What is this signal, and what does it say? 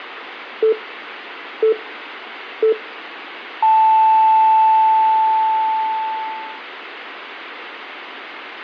Radio time signal (three low pips and a long one an octave up, as on NHK), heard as pips.